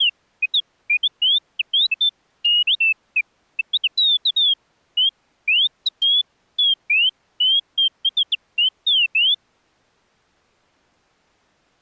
Bird-like chirps. There is no code.